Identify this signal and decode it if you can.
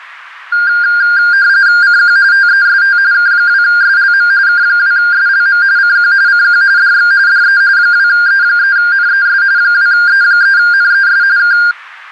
RTTY (45.45 baud, 170 Hz shift), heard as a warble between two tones, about 1500 Hz centre. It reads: CQ TEST K2SLM K2SLM CQ CQ DX DE 2E3NES 2E3NES K